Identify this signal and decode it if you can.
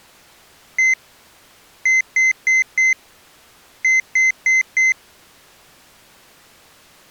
Beep code, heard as a piezo beeper, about 2050 Hz. 1-4-4.